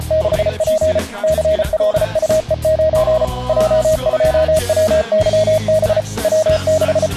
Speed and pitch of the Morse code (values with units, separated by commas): 34 wpm, 630 Hz